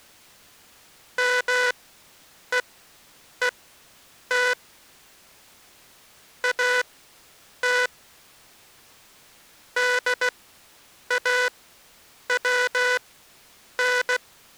Morse code, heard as a buzzer, machine-sent, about 16 wpm, spaced as for 8 wpm. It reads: MEET AT DAWN